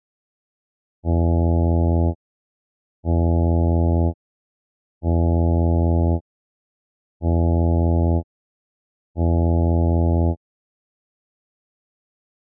Ship horn signal, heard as a ship's horn, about 80 Hz. 5 short. At sea: I doubt that you are doing enough to avoid a collision.